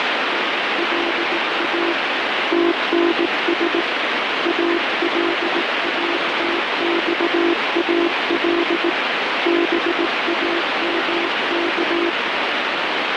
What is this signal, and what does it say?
Morse code (Arabic alphabet), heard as a keyed tone, hand-sent with a paddle, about 18 wpm, 340 Hz, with heavy radio static. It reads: لا تنس الاتصال بامك